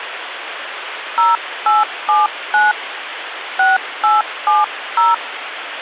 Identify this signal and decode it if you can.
DTMF, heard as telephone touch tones, dialled by hand, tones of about 170 ms, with phone line noise. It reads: 0879 6870